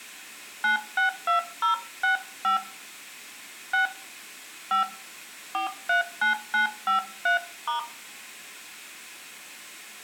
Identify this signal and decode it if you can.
DTMF, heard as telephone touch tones, dialled by hand, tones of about 120 ms, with room echo. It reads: 962065 6 5 439953*